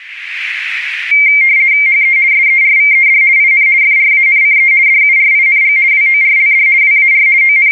RTTY (50 baud, 170 Hz shift), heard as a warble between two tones, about 2200 Hz centre, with radio static. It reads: HE SERVED IN FRANCE DURING WORLD WAR …